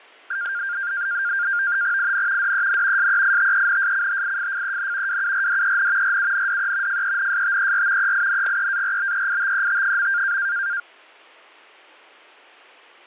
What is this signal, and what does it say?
NAVTEX (SITOR-B), 100 baud, 170 Hz shift, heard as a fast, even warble, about 1500 Hz centre, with fading and static crashes. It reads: IN DEN SEITENSCHIFFEN WURDEN RUNDE FENSTER EINGEARBEITET.